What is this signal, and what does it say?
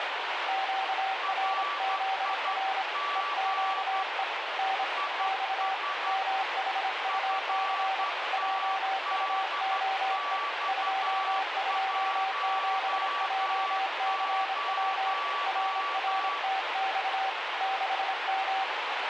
Morse code, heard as two keyed tones, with heavy radio static. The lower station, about 26 wpm, 770 Hz: QRZR EQE N X MHUC JUOE 227JCW RRTX 6M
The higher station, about 12 wpm, 1150 Hz: RIG IS FTDX10